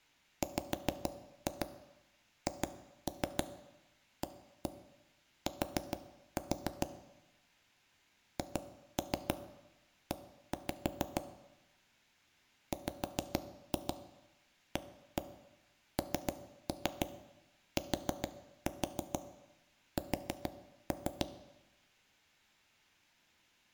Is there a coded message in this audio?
Yes: tap code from 0.4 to 21.2 s, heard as taps on a table, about 6 knocks a second, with room echo. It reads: WHAT HE WANTS